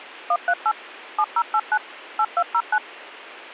DTMF, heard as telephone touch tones, dialled by machine, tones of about 60 ms, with a squelch burst at the end. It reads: 138 7089 8209